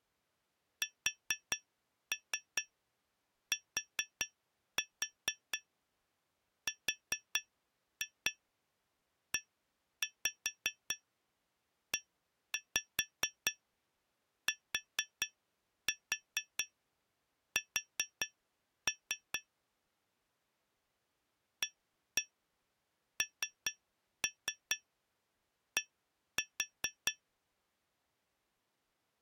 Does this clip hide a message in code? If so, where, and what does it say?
Yes: tap code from 0.8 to 27.2 s, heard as taps on glass, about 4 knocks a second. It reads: STREETS AND